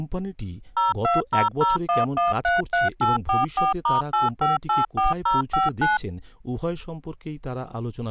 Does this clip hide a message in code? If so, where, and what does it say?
Yes: DTMF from 0.8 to 6.0 s, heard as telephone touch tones, dialled by machine, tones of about 160 ms, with speech in Bangla. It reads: 02001133844*8584059